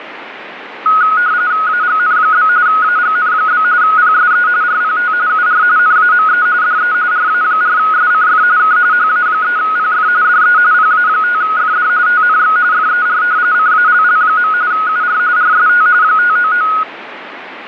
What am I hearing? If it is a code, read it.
RTTY (45.45 baud, 170 Hz shift), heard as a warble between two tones, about 1360 Hz centre, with radio static. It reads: AGN? AGN? PSE RPT UR NAME DE RA4SCF K HA3PF DE PA5FD TNX FER CALL. UR RST 599